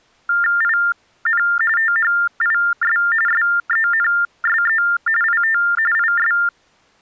TTY/TDD text telephone tones (45.45 baud Baudot), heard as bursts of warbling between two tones, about 400 Hz shift, 1600 Hz centre. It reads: IN THIS SENSE IT IS